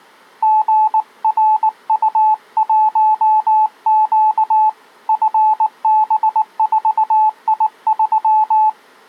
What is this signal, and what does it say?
Morse code, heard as a keyed tone, hand-sent with a paddle, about 19 wpm, 860 Hz. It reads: GRU1Q FB4I3